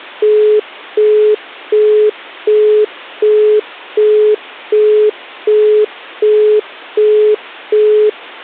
Telephone call progress tone (as in the UK, Australia and similar networks), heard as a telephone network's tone, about 420 Hz, 0.375 s on and 0.375 s off. Busy tone.